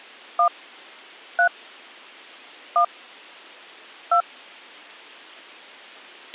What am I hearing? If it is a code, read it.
DTMF, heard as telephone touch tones, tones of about 90 ms, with a squelch burst at the end. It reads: 1 3 1 2